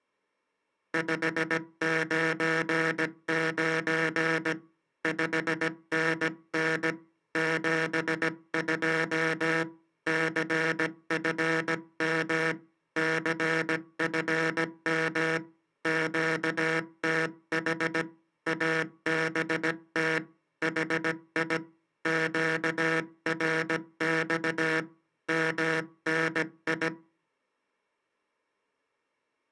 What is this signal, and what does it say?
Morse code, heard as a buzzer, hand-sent with a paddle, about 17 wpm. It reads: 599 5NN 72 CFM CFM QTH ABT HI QRX MNI